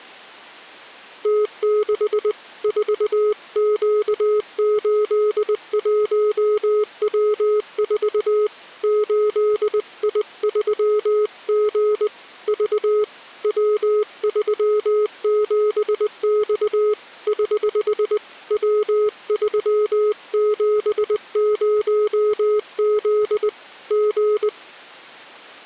Morse code, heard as a keyed tone, hand-sent with a paddle, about 20 wpm, 420 Hz. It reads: T6 4Q81W4 8I3G V W37X <HH> W370Z G